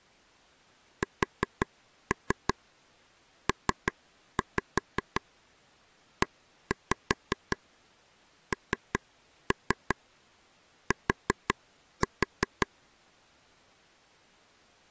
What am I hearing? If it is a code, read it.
Tap code, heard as taps on a table, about 5 knocks a second. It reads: SPENT